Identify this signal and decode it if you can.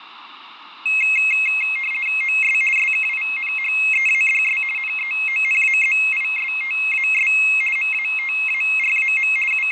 RTTY (50 baud, 450 Hz shift), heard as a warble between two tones, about 2350 Hz centre, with fading. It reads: OS SKINHEADS NEONAZISTAS MATARAM …